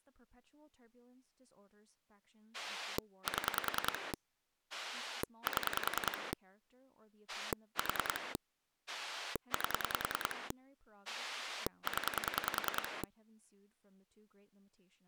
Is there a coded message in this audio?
Yes: pulse dialling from 2.5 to 13.0 s, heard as a rotary dial, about 10 pulses a second, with speech in English. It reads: 7 7 4 8 0